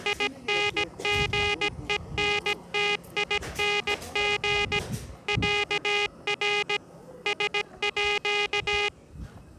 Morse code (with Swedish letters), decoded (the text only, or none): INGENTING ÄR SÅ